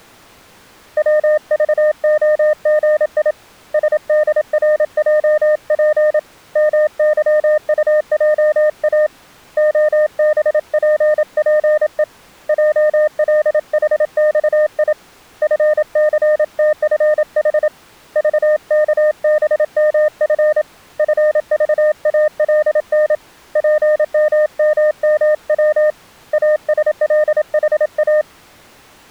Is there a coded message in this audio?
Yes: Morse code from 0.9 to 28.3 s, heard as a keyed tone, hand-sent with a paddle, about 27 wpm, 610 Hz. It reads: WVOGI SDRJP MYUJA OBPPE JLHXI FCTFH VKBMF FVALN PMMMW ASLHA